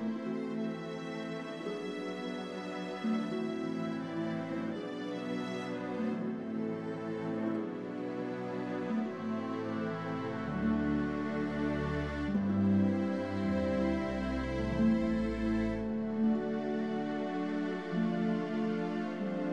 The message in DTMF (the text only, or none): none